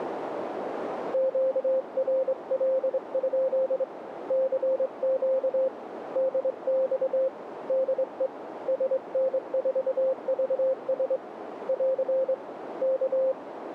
Morse code, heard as a keyed tone, hand-sent with a straight key, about 24 wpm, 530 Hz, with radio static and a narrow filter. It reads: QRL? CQ DX DE SN4VS <AR> K